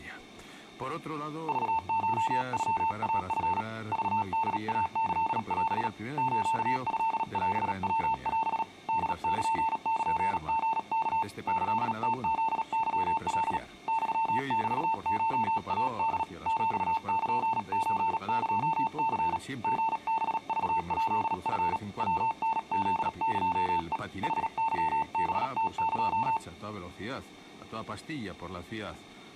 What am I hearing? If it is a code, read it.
Morse code (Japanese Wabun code), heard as a keyed tone, hand-sent with a paddle, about 37 wpm, 900 Hz. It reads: クコノイチ クホイキオ ストオヤオ ホルルリワ キムフケカ ユメコイホ ヒルソエニ リハクヱチ ヤタフエヘ ヌケハムエ